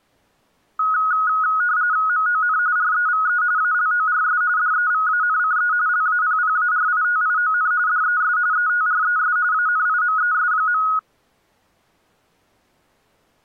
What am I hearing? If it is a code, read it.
RTTY (45.45 baud, 170 Hz shift), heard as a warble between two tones, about 1360 Hz centre. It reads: MON REVE ALORS DEVANCE LAPPARITION DES ETRES ANIMES.